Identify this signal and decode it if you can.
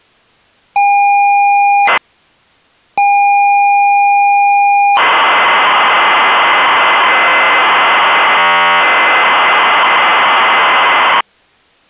ZX Spectrum tape loading, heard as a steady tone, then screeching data.